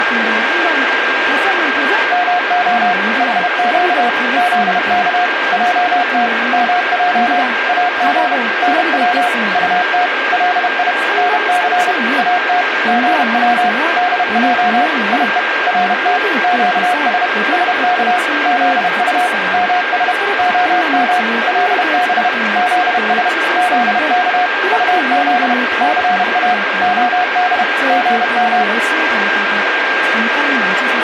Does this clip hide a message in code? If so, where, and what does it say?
Yes: Morse code (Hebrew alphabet) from 2.1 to 28.7 s, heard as a keyed tone, machine-sent, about 31 wpm, 720 Hz, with radio static, a steady whistle near 1600 Hz and speech in Korean. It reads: מה חק זך עת מע אג נץ טת לי נס את גץ דע יו רת קש שך זט מש הם לב זש זך טז סא הד גם